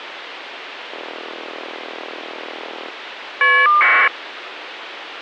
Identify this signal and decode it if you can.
Caller ID data burst, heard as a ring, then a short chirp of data, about 1200 baud, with phone line noise.